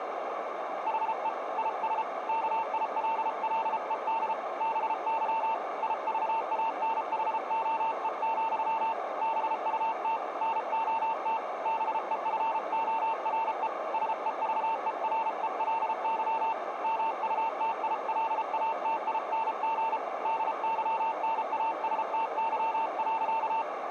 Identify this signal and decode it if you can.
Morse code, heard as a keyed tone, hand-sent with a paddle, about 33 wpm, 900 Hz, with radio static and a narrow filter. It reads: HE IS KILLED BY IVANHOE, BUT NOT BEFORE SEVERELY MUTILATING DYNASTY.